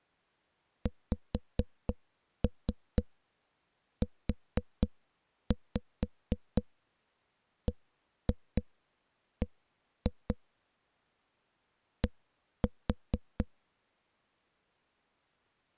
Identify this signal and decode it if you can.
Tap code, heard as knocks on a wall, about 4 knocks a second. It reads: XUBB D